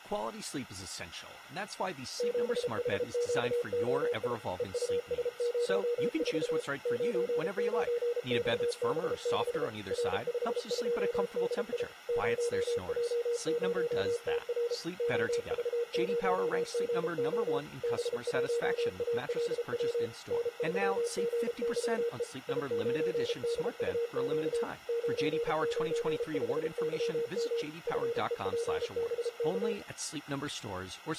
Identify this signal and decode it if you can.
Morse code, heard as a keyed tone, machine-sent, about 33 wpm, 470 Hz, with speech in English. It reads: 7HQOI EUS04 99XB6 R52DI 0J0TR OV0GO B1ALW N3GYE I9DUQ 995YM FEPBK